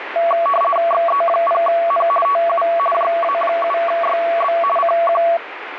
RTTY (50 baud, 450 Hz shift), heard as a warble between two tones, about 900 Hz centre, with radio static. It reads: XE0N TU JA7YB CQ